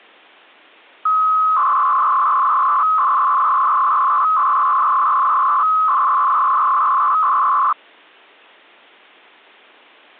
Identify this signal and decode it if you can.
300-baud modem data (Bell 103 tones), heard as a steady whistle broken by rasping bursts, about 300 baud, 200 Hz shift.